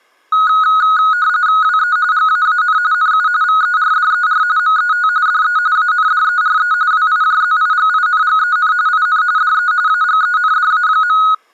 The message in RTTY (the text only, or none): WE GAAN NU VERDER MET DE ANDERE WIJZIGINGEN IN DE AGENDA.